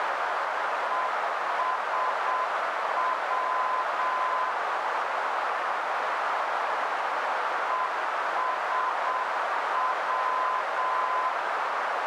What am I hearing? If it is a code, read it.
Morse code, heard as a keyed tone, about 7 wpm, 1020 Hz, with heavy radio static and a narrow filter. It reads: ESW ESW